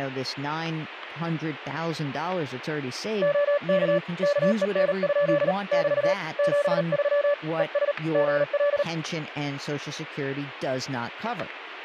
Morse code, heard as a keyed tone, hand-sent with a paddle, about 38 wpm, 580 Hz, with speech in English. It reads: OK KEN? <BT> 73 ES GL